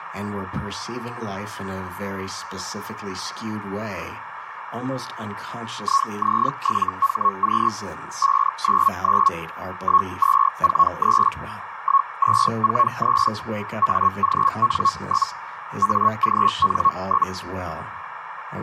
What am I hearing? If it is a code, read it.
Hellschreiber (Feld-Hell, 122.5 baud), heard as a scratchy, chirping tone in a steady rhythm, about 1100 Hz, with radio static and a narrow filter. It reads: IZ7HQ 599 1243 1243 AGN? AGN?